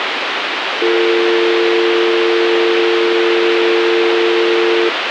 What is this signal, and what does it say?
Telephone call progress tone (North American or UK plan), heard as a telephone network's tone, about 350, 450 Hz, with phone line noise. Dial tone.